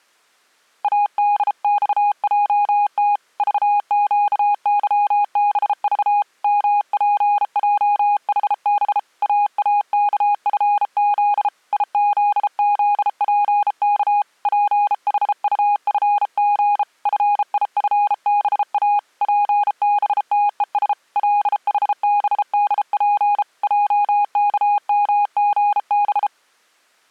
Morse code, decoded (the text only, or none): ADXJT VQYBV MPJHB AAKFZ IZZPK PHUFG FIFBA PBTES LHBDP JKMGB